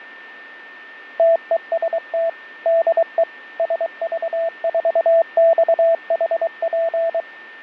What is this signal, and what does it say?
Morse code, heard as a keyed tone, machine-sent, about 23 wpm, 660 Hz, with fading and a steady whistle near 1800 Hz. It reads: TEST DE SV4XHP